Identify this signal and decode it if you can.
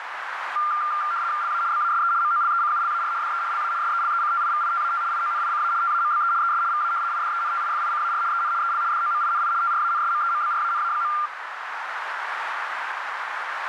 RTTY (75 baud, 170 Hz shift), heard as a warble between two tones, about 1290 Hz centre, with radio static and a narrow filter. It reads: LA BASE MOLECULAR DE LA SELECTIVITAT IONICA TAMBE ES VA IDENTIFICAR EN EL DOMINI TRANSMEMBRANA.